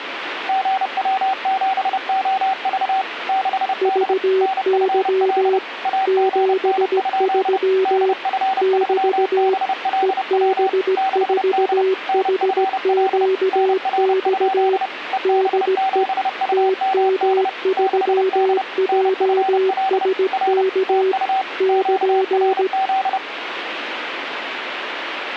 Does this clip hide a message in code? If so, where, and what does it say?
Yes: Morse code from 0.4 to 23.2 s, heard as two keyed tones, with radio static. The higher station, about 30 wpm, 770 Hz: GW7OV 6D NFL AGN? DF3BLW 6D NFL NR? EB7UMD 6D NFL R TU QRZ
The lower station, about 17 wpm, 380 Hz: VY 73 <BT> EB4HQX DE TM3JSK <KN>